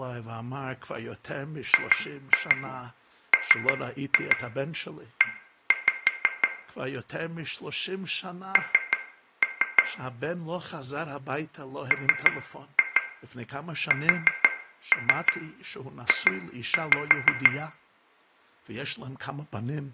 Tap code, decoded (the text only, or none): GME N MSJ